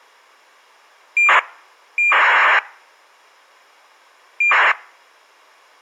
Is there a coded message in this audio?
Yes: ACARS aircraft data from 1.2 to 4.7 s, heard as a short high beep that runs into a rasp, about 2400 baud.